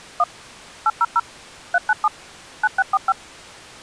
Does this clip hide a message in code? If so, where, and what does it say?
Yes: DTMF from 0.2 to 3.1 s, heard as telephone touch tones, dialled by machine, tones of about 40 ms. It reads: 1 800 397 9645